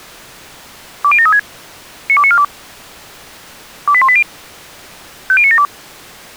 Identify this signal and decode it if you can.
Five-tone selective call (ZVEI), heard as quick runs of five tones, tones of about 70 ms. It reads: 20736 92942 28180 50972